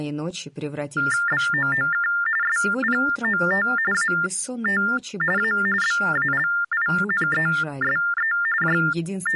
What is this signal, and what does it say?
TTY/TDD text telephone tones (45.45 baud Baudot), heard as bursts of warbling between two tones, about 400 Hz shift, 1600 Hz centre. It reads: BOOK SPOT AT A BALINESE …